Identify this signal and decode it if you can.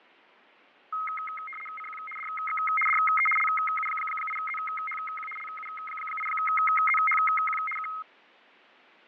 RTTY (75 baud, 850 Hz shift), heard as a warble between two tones, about 1700 Hz centre, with fading. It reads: CQ DX DE LU8ZHQ LU8ZHQ K